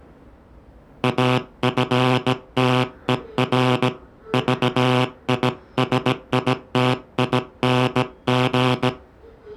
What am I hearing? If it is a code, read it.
Morse code, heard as a buzzer, hand-sent with a bug key, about 17 wpm, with the noise of a subway station. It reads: AFTER VISITING